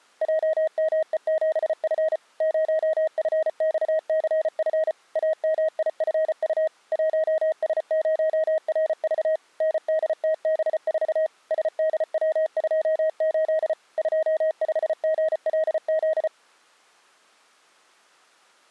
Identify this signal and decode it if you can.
Morse code, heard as a keyed tone, machine-sent, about 34 wpm, 630 Hz. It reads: JME7F 0FXCF AMIFU 1S0RV NDTB4 SDW28 25GLZ